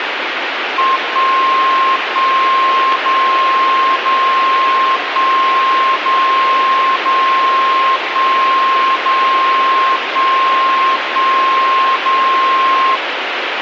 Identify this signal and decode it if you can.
Radio time signal (DCF77), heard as a tone whose level steps once a second, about 1060 Hz, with radio static. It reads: 1 1 0 0 1 0 0 1 0 1 1 0